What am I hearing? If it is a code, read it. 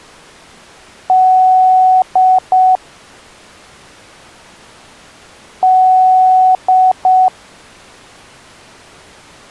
Beep code, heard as beeps, played twice, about 750 Hz. 1 long, 2 short. In Award, IBM and AMI BIOS tables: video adapter failure.